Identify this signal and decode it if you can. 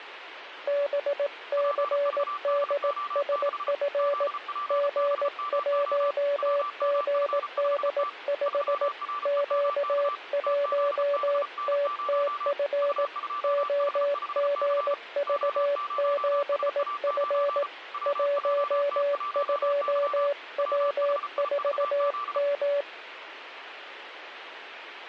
Morse code, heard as two keyed tones, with radio static. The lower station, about 18 wpm, 570 Hz: BCDSF G1GD5 Q1TTF OGV7F 12W4M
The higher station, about 34 wpm, 1170 Hz: PVDO6 ZPBMO WMF5T 3REMK TZBN0 U2H5C O0SA9 WJT1Y WHIVZ